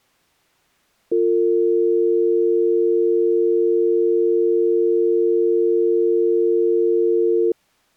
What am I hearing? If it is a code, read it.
Telephone call progress tone (North American or UK plan), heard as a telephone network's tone, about 350, 450 Hz. Dial tone.